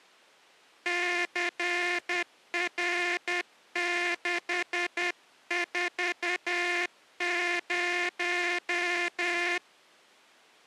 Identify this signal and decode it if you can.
Morse code, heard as a buzzer, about 10 wpm. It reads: CR640